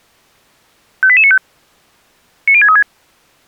Five-tone selective call (ZVEI), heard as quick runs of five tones, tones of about 70 ms. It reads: 58895 90636